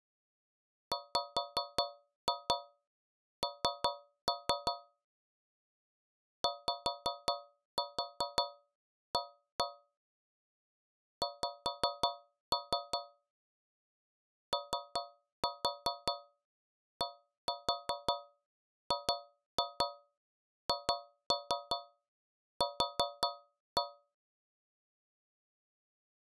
Tap code, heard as taps on a metal pipe, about 5 knocks a second. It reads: WN YA X ODGHQ